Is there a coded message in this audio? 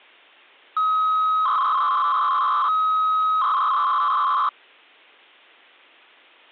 Yes: 300-baud modem data (Bell 103 tones) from 0.8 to 4.5 s, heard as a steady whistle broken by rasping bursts, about 300 baud, 200 Hz shift.